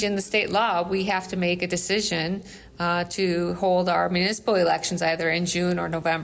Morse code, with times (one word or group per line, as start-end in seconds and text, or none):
none